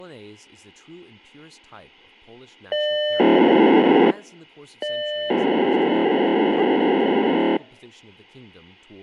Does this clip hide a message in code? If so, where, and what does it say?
Yes: POCSAG pager data (1200 baud) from 2.7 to 7.6 s, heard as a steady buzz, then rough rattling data, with speech in English.